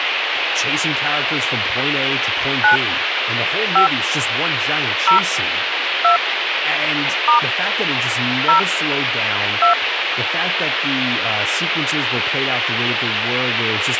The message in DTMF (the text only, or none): 9 5 0 2 * 0 2